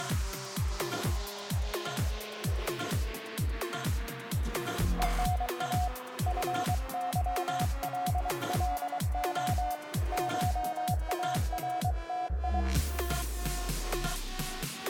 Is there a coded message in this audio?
Yes: Morse code (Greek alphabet) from 4.9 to 12.7 s, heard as a keyed tone, hand-sent with a paddle, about 23 wpm, 730 Hz, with room echo. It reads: ΕΝΑ ΦΥΛΛΟ ΧΑΡΤΙ